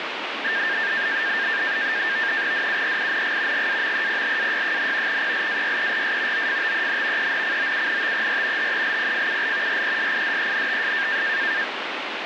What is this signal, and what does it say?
NAVTEX (SITOR-B), 100 baud, 170 Hz shift, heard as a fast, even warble, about 1700 Hz centre, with radio static. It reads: DURING GAMEPLAY, PLAYERS OFTEN ENCOUNTER HELPFUL RESIDENTS